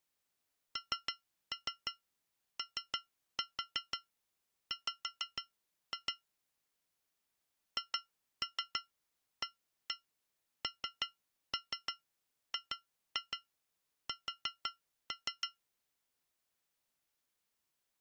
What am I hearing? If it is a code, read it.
Tap code, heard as taps on glass, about 6 knocks a second. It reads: NOW HANGS